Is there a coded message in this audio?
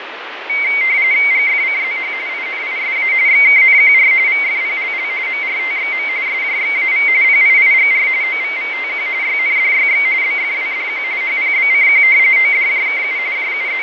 Yes: RTTY (45.45 baud, 170 Hz shift) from 0.5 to 13.8 s, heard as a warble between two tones, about 2150 Hz centre, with radio static and fading. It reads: GFCZH INISA XKNQR VFPLL MRTXM SJXAV PIIGR OVVTQ YNDYX BFWDQ HPBCQ ODJKU …